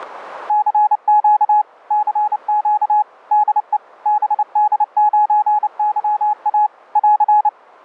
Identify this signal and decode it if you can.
Morse code, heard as a keyed tone, machine-sent, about 29 wpm, 840 Hz. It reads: CQ CQ DE BD9YA <AR>